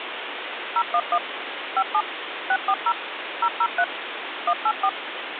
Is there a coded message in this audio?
Yes: DTMF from 0.8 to 4.9 s, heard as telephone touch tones, dialled by machine, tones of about 60 ms, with phone line noise. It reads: 011 57 640 003 184